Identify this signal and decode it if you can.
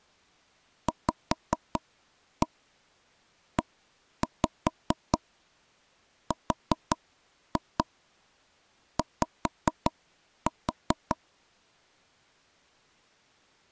Tap code, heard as taps on a table, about 5 knocks a second. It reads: VERY